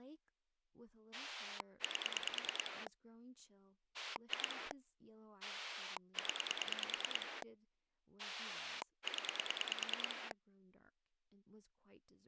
Pulse dialling, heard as a rotary dial, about 9 pulses a second, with speech in English. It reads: 8 2 0 0